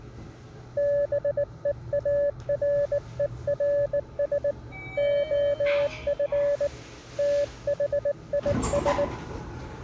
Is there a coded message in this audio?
Yes: Morse code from 0.7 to 9.1 s, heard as a keyed tone, hand-sent with a bug key, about 19 wpm, 570 Hz, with the noise inside a lift. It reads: BEARERS OF THIS